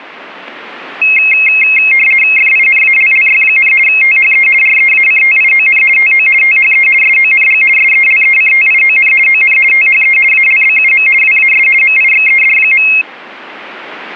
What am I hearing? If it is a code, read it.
RTTY (50 baud, 450 Hz shift), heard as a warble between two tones, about 2350 Hz centre. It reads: FINALLY, THE REACTION TO THE SONG SELECTION ON THE ALBUM WAS MIXED.